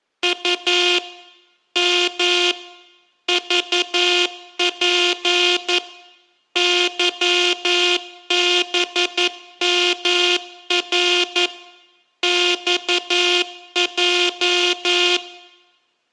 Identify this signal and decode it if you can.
Morse code, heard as a buzzer, machine-sent, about 11 wpm. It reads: U M VP YBMR XJ